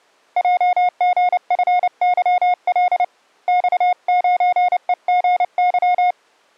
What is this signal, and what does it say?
Morse code, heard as a keyed tone, hand-sent with a paddle, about 29 wpm, 720 Hz. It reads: JGFYL X9EGY